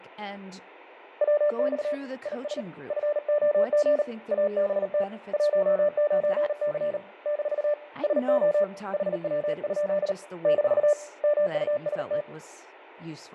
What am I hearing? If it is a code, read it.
Morse code, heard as a keyed tone, hand-sent with a paddle, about 38 wpm, 590 Hz, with radio static, fading, room echo and speech in English. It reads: WX IS FOG ABT 19C - SO HW? - MUST